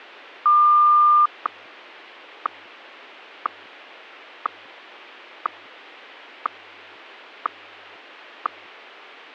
Radio time signal (WWVH, Hawaii), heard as ticks, one a second.